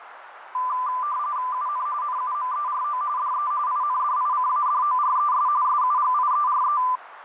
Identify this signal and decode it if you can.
RTTY (45.45 baud, 170 Hz shift), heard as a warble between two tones, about 1100 Hz centre, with radio static and a narrow filter. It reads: UN NUMERO DE INDICADORES SUGIERE